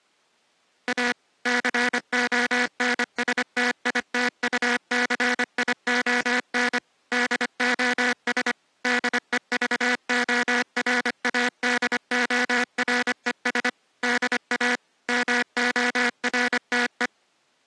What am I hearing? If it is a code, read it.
Morse code, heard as a buzzer, machine-sent, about 25 wpm. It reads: A CONSTITUCION DOS DEVORADORES DA MORTE